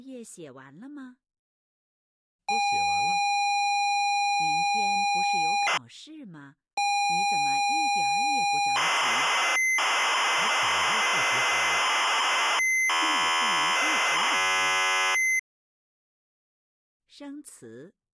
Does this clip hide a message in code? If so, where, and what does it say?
Yes: ZX Spectrum tape loading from 2.5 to 15.4 s, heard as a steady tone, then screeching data.